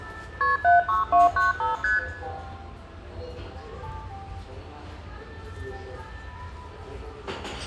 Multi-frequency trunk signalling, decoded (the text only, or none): KP 76295 ST